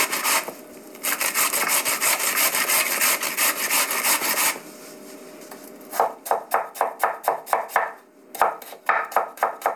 Kitchen noise. There is no code.